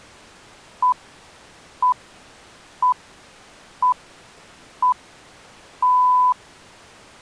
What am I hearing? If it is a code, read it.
Radio time signal (six pips, as the Greenwich Time Signal), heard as pips.